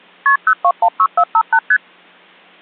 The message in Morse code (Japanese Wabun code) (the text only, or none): none